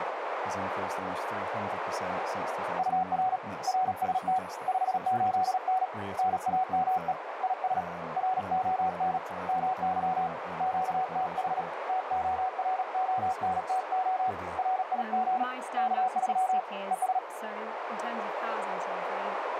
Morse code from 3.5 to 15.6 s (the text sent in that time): RST 58N NAME IS RON MY QTH TORONTO RIG